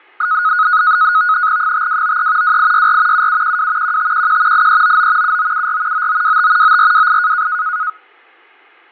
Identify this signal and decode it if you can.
NAVTEX (SITOR-B), 100 baud, 170 Hz shift, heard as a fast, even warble, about 1360 Hz centre, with fading. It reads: 5293 2864 7712 1511 8399 7974 9925 9428